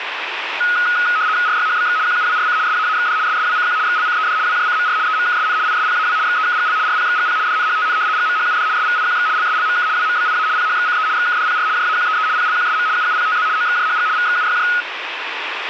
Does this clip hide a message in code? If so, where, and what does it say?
Yes: RTTY (75 baud, 170 Hz shift) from 0.6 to 14.8 s, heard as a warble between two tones, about 1360 Hz centre, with radio static. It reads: RYHBX QUWRC SAAXD SSWCQ XLCED WJCMR EMKSN ISPAW XEKGL RPXGP DNHTN GMHUD SVIQX LSLMK WMBIA PHXCE XKDPR JAQEE PLQSM UUPTZ OXJHG VXUYJ